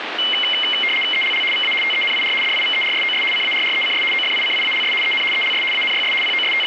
RTTY (75 baud, 850 Hz shift), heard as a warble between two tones, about 2550 Hz centre, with radio static. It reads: ELL VA TENIR DIVERSOS CARRECS OFICIALS EN ELS ANYS …